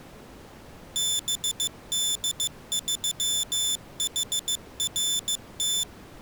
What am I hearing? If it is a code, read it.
Morse code, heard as a high beeper, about 15 wpm, 3500 Hz. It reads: BD3HRT